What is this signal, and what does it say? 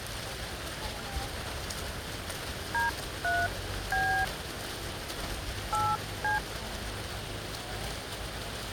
DTMF, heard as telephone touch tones, dialled by hand, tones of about 250 ms, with the noise of a park. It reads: D3B 8C